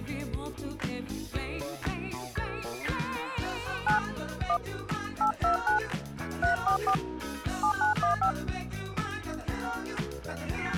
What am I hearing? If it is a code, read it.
DTMF, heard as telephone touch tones, dialled by hand, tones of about 110 ms. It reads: 9 1 829 344 7915